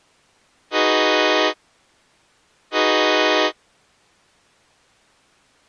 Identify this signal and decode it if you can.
Train horn signal, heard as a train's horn. 2 short. On North American railways: a signal is acknowledged.